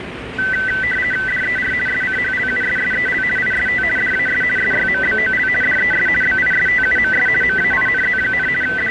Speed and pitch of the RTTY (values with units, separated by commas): 50 baud, 450 Hz shift, 1750 Hz centre